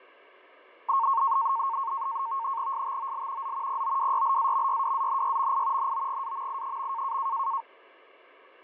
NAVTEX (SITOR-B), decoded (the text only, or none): STOL Z POWYLAMYWANYMI NOGAMI.